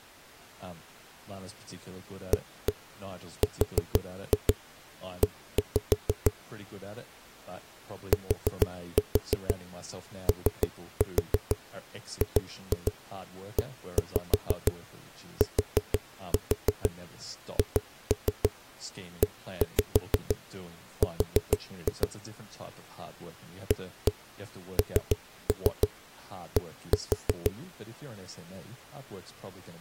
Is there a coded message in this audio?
Yes: tap code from 2.3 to 27.5 s, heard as knocks on a wall, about 6 knocks a second, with speech in English. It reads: ARE TOGETHER AND